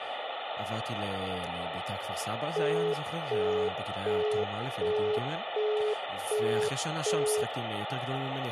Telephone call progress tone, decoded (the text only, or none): busy tone